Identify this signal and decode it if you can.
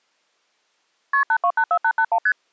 Multi-frequency trunk signalling (R1, as on North American trunks), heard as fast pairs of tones, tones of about 70 ms. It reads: KP 8284881 ST